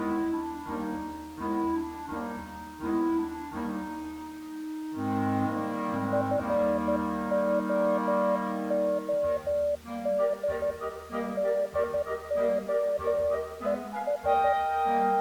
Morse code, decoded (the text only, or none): FOOD DOES